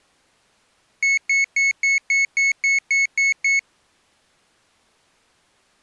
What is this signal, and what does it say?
Beep code, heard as a piezo beeper, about 2200 Hz. 10 short. In AMI BIOS tables: CMOS shutdown register error.